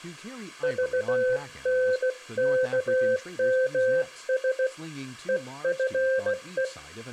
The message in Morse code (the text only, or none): VNKMS EFE